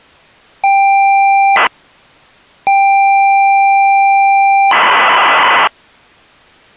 ZX Spectrum tape loading, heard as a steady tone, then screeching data.